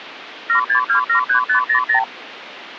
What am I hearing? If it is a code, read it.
Multi-frequency trunk signalling (R2, with the far end's replies), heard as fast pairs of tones, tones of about 100 ms, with phone line noise. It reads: 76273500